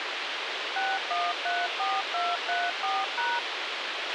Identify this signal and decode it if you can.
DTMF, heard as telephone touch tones, dialled by machine, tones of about 220 ms, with radio hiss and a squelch burst at the end. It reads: 6134234#